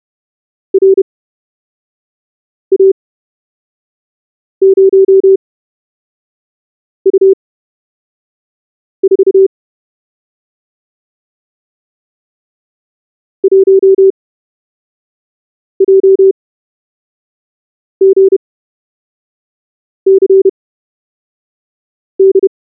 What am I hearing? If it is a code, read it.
Morse code, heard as a keyed tone, machine-sent, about 31 wpm, spaced as for 5 wpm, 380 Hz. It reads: RA0U4 1JGCD